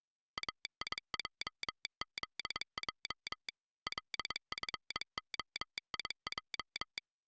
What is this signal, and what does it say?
Morse code, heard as a telegraph sounder, machine-sent, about 22 wpm. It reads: AIJZJ LFOIJ